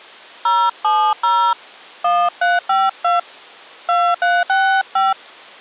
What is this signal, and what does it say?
DTMF, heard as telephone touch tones, dialled by hand, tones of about 230 ms. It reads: 070 1352 2365